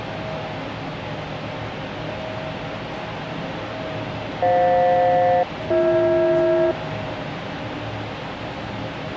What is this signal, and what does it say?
Aircraft SELCAL, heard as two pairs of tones, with the noise inside a lift. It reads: FJ-BH